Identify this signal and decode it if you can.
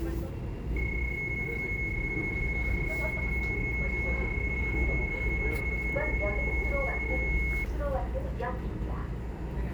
PSK31 (31.25 baud), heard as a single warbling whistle, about 2200 Hz, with the noise inside a subway train.